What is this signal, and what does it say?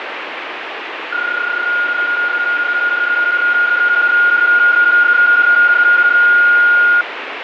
PSK31 (31.25 baud), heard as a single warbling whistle, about 1430 Hz, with radio static.